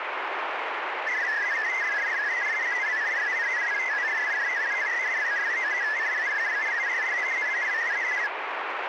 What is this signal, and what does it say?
Multi-tone FSK (Olivia or MFSK type), about 500 Hz wide, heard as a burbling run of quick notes, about 62.5 baud, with radio static.